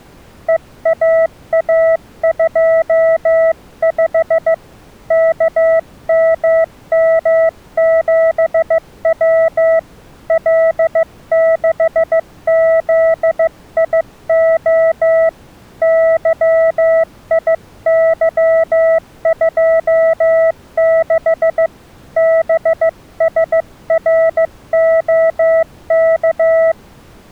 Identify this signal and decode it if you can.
Morse code, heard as a keyed tone, hand-sent with a bug key, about 15 wpm, 650 Hz. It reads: EAA25 KMM7W L6ZIO YIY26 BSROK